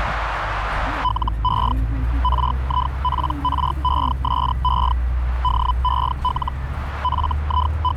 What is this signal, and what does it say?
Hellschreiber (Feld-Hell, 122.5 baud), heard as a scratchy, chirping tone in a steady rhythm, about 1000 Hz, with radio static and the noise inside a bus. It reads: LE RIPRESE DEL …